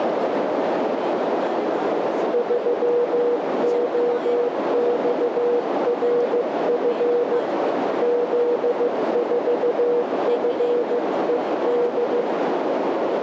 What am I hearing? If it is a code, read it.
Morse code, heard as a keyed tone, hand-sent with a paddle, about 15 wpm, 480 Hz, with heavy radio static, a narrow filter and speech in Malayalam. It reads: 3OXRF Z4FED